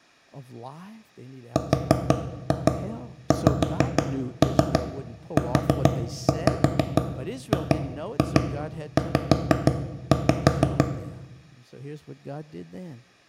Tap code, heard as knocks on wood, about 6 knocks a second, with room echo and speech in English. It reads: RXUGZ